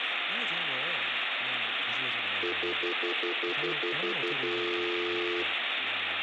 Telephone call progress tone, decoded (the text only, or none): stutter dial tone